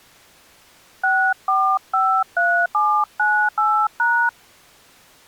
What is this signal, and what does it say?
DTMF, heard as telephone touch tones, dialled by hand, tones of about 300 ms. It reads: 6453798#